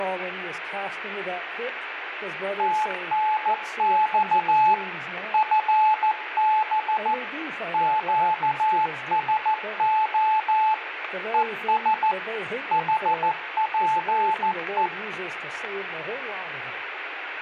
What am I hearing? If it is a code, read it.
Morse code, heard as a keyed tone, machine-sent, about 14 wpm, 870 Hz, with radio static and room echo. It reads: TNX FB QSO ES HPE